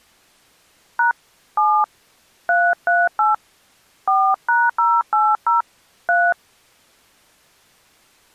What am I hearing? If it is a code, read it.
DTMF, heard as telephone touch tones, dialled by hand, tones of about 200 ms. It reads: # 7 338 4#080 3